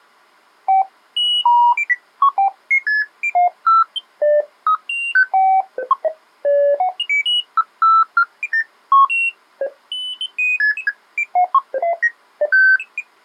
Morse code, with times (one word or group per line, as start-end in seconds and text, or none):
none